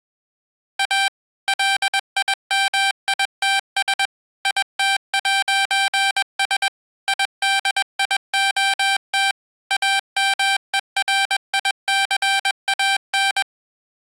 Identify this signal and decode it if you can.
Morse code, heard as electronic beeps, machine-sent, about 21 wpm, 780 Hz. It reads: A LIMITS IT'S IDIOT AMERICAN